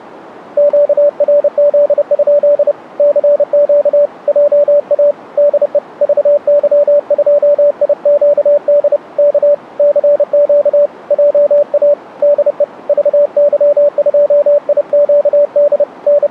Morse code, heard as a keyed tone, hand-sent with a paddle, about 30 wpm, 580 Hz. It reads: QRZ? CQ JA DE VY2IQD K CQ JA DE VY2IQD …